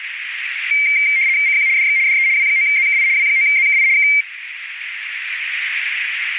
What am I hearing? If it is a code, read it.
RTTY (75 baud, 170 Hz shift), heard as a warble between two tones, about 2200 Hz centre, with radio static and a narrow filter. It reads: CQ DX DE W9ZKI W9ZKI K